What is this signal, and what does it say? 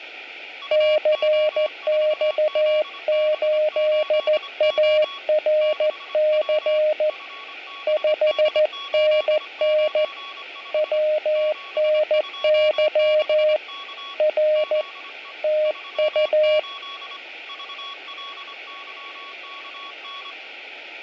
Morse code, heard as two keyed tones, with room echo. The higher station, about 25 wpm, 1120 Hz: UO4ZB8O 6W FBD895 726K ZE 38 VLYKN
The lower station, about 14 wpm, 610 Hz: CX8ARC 5NN WNY R TU